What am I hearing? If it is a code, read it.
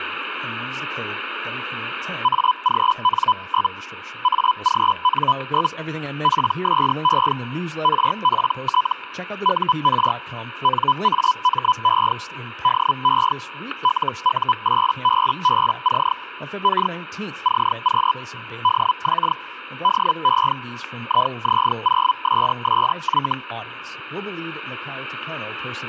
Hellschreiber (Feld-Hell, 122.5 baud), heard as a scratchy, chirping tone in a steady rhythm, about 1000 Hz, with static crashes and speech in English. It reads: AGN? AGN? PSE RPT UR NAME DE LU8BBC K CQ DX DE IZ0SSY